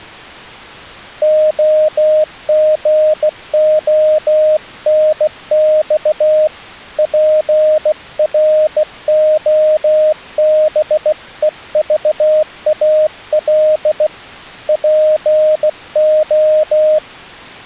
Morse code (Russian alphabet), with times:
1.2-6.5 ОГОНЬ
7.0-14.1 ПРОБЕЖАЛ
14.7-17.0 ПО

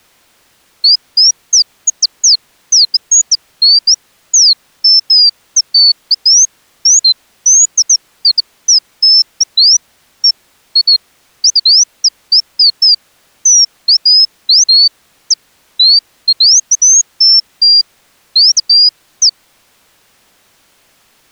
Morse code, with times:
none

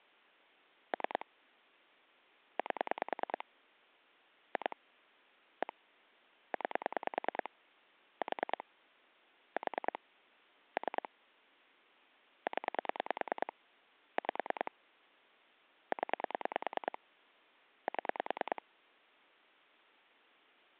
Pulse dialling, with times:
0.9-1.3 3
2.6-3.4 8
4.6-4.8 2
5.6-5.7 1
6.5-7.5 9
8.2-8.6 4
9.6-10.0 4
10.8-11.1 3
12.5-13.5 0
14.2-14.7 5
15.9-17.0 0
17.9-18.6 7

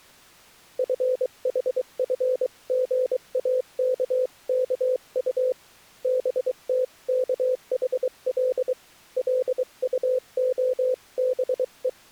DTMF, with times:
none

